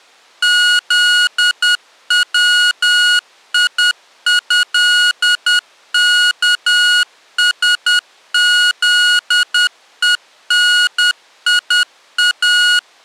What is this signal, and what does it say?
Morse code (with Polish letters), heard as electronic beeps, machine-sent, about 10 wpm, 1450 Hz. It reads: ZWIĘKSZENIA